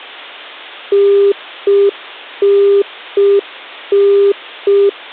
Telephone call progress tone (UK plan), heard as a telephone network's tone, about 400 Hz. Congestion tone.